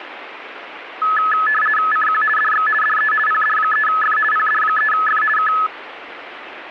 RTTY (50 baud, 450 Hz shift), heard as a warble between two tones, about 1500 Hz centre, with radio static. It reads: CQ DX DE PD3F PD3F K